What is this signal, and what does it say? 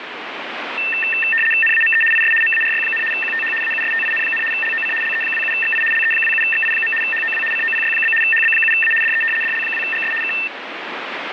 RTTY (75 baud, 850 Hz shift), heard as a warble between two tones, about 2250 Hz centre, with radio static. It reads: NAME IS MARY, QTH AUSTIN, LOC LE27XI LE27XI. HOW COPY? HB7A DE DL2GS K